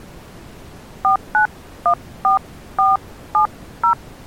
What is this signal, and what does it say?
DTMF, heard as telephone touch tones, dialled by hand, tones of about 130 ms. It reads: 4914470